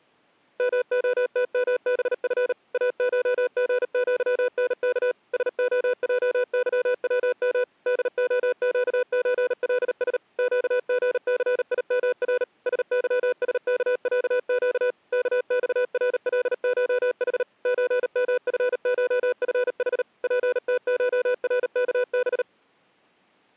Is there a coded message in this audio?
Yes: Morse code (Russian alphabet) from 0.5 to 22.5 s, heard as a keyed tone, machine-sent, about 38 wpm, 500 Hz. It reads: МОТМБФ АШГЪНК СОЙЫВМ ДОЩЧЛС ЩГЦИМР СЫСКЯЩ КЬРЛШХ ЧМФШФХ ПТШРКБ